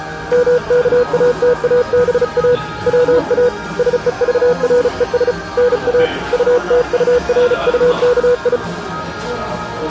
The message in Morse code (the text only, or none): MKATABA WA SEVRES NA UTURUKI